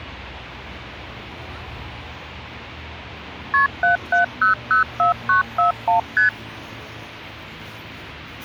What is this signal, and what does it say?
Multi-frequency trunk signalling (R1, as on North American trunks), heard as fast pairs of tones, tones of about 120 ms, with street noise. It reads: KP 77004941 ST